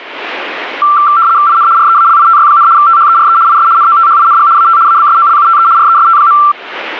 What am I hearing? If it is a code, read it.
RTTY (75 baud, 170 Hz shift), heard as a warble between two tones, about 1260 Hz centre. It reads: IN REALITY, THERE IS NOTHING AT ABSOLUTE REST.